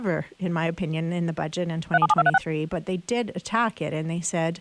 DTMF, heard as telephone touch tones, dialled by machine, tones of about 40 ms, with speech in English. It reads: 377236